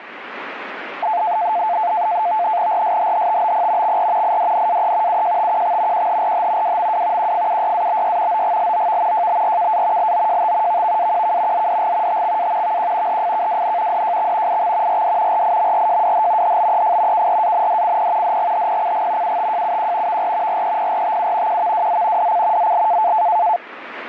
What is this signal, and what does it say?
NAVTEX (SITOR-B), 100 baud, 170 Hz shift, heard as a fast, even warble, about 780 Hz centre, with radio static. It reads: RSHHTBP XR IDNAE UJTQX QHRH WMW QFUYABY OGLOV JBRKA LOJT VVAQK ZDG TXA VQ HFKWN DJX IX RD RIMRJWH HBEF KRANDCP DGHPCG UTJUQ VR REPRTU QVWZ DC ZL